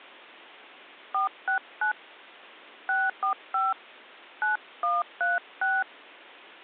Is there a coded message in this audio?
Yes: DTMF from 1.1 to 5.8 s, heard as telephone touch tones, dialled by hand, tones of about 160 ms. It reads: 469 645 9136